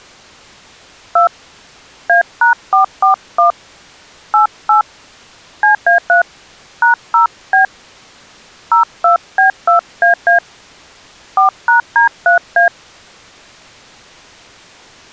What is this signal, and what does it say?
DTMF, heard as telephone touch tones, dialled by hand, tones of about 120 ms. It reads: 2 A#441 88 CA3 #0B 02B2AA 4#D3A